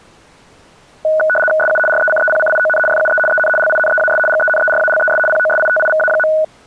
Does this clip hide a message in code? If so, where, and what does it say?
Yes: RTTY (75 baud, 850 Hz shift) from 1.0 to 6.4 s, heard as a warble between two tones, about 1050 Hz centre. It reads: SU RECEPCION FUE EN LINEAS GENERALES POSITIVA.